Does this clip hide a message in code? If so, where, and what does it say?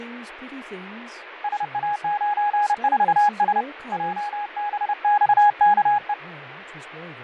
Yes: Morse code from 1.4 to 6.2 s, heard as a keyed tone, hand-sent with a paddle, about 30 wpm, 830 Hz, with radio static, fading and speech in English. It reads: SA94S JBXKE